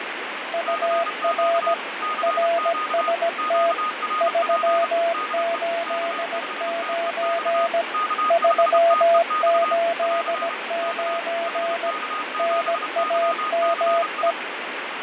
Morse code, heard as two keyed tones, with radio static and fading. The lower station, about 17 wpm, 680 Hz: UR RST 389 389 NAME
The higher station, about 30 wpm, 1240 Hz: CQ CQ QRP DE K5TEX K5TEX <AR> K HK7YCI